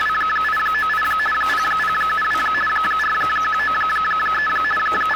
RTTY (50 baud, 450 Hz shift), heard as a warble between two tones, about 1500 Hz centre, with radio static and kitchen noise. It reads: … 0072 4193 …